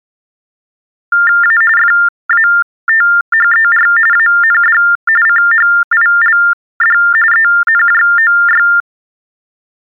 TTY/TDD text telephone tones (45.45 baud Baudot), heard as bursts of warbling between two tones, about 400 Hz shift, 1600 Hz centre. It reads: A FATHER AND CHILD ENJOY